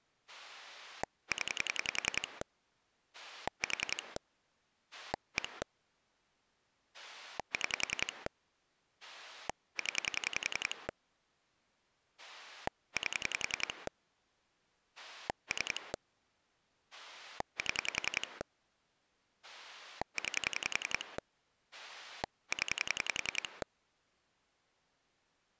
Pulse dialling, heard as a rotary dial, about 10 pulses a second. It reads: 0 4 1 6 0 8 3 7 9 0